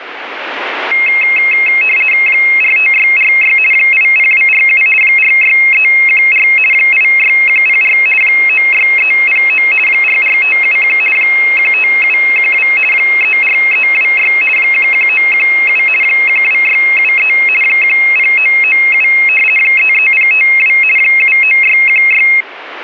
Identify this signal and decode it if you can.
RTTY (50 baud, 450 Hz shift), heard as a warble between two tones, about 2350 Hz centre, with radio static. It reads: 45646 80247 46314 86104 96309 44571 15712 34326 11917 12673 10997 33052 79616